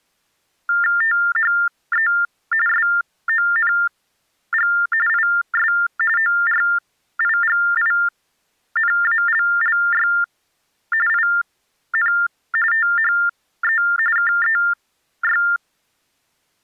TTY/TDD text telephone tones (45.45 baud Baudot), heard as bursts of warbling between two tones, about 400 Hz shift, 1600 Hz centre. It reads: THE SONG IS ORIGINALLY IN THE KEY